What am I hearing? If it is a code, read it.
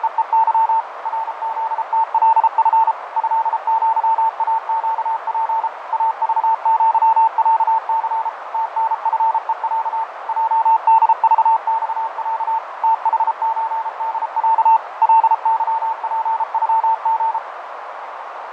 Morse code (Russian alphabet), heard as a keyed tone, machine-sent, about 33 wpm, 900 Hz, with radio static, fading and a narrow filter. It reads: … РЗТЛФ ЭЪАЩП АЖЪЯЦ ТНФЕЯ ЙДЖЬЯ ТХЧДЯ ЛЫПЮГ